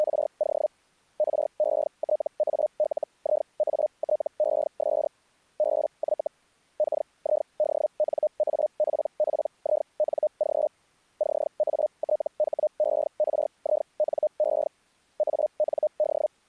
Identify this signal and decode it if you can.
Hellschreiber (Feld-Hell, 122.5 baud), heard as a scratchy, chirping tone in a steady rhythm, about 610 Hz. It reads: … RETALIATES BY KIDNAPPING CATHERINE AND